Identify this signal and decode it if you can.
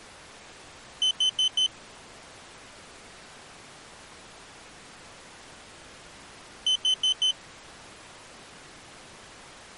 Alarm pattern, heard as an alarm's beeps, played twice, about 3050 Hz. Temporal four. Carbon monoxide.